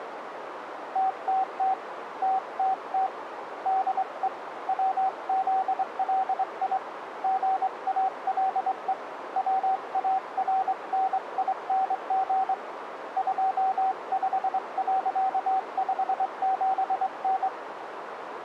Morse code, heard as a keyed tone, hand-sent with a straight key, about 23 wpm, 760 Hz, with radio static and a narrow filter. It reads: TTT TTT DE WZLI GALE WARNING 25.57N